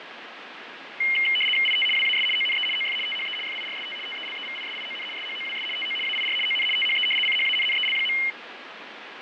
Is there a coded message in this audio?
Yes: RTTY (75 baud, 850 Hz shift) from 1.0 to 8.3 s, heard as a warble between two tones, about 2550 Hz centre, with radio static and fading. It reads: IT WAS ONE OF THE FIRST TELEVISION SHOWS TO AIR ON THE CHANNEL.